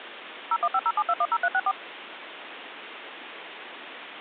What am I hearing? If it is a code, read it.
DTMF, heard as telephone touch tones, dialled by machine, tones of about 50 ms, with phone line noise. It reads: 01507210364